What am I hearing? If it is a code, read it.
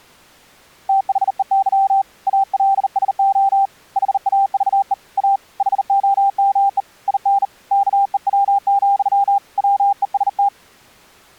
Morse code, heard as a keyed tone, hand-sent with a bug key, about 39 wpm, 790 Hz. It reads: THEY ALSO HAVE A HOME IN KEW, WEST